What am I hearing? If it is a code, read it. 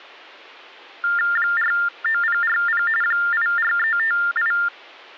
TTY/TDD text telephone tones (45.45 baud Baudot), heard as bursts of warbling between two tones, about 400 Hz shift, 1600 Hz centre. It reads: 49040 84358